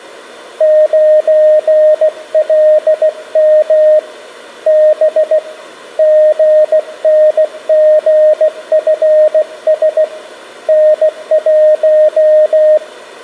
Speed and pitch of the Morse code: 16 wpm, 620 Hz

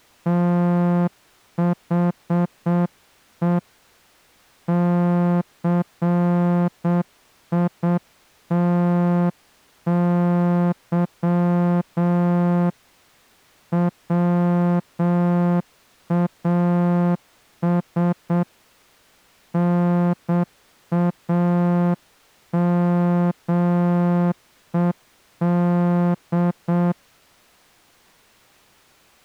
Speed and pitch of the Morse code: 7 wpm

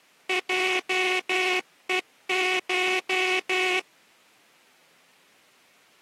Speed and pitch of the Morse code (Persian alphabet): 12 wpm

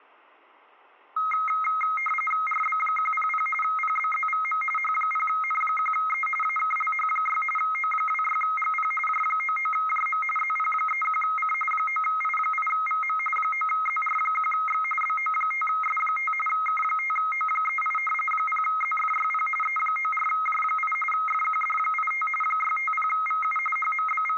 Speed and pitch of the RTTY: 45.45 baud, 850 Hz shift, 1700 Hz centre

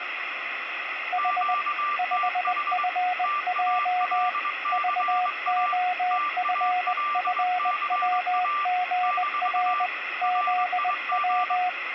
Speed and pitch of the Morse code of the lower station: 20 wpm, 730 Hz

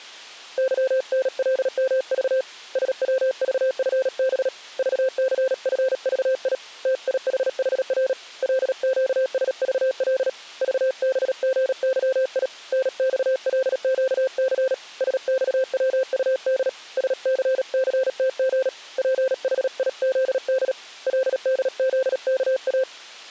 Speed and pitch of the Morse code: 37 wpm, 520 Hz

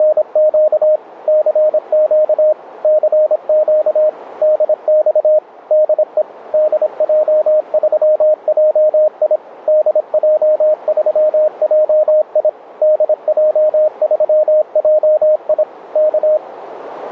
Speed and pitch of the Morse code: 26 wpm, 620 Hz

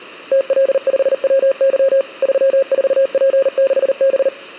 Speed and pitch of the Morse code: 39 wpm, 540 Hz

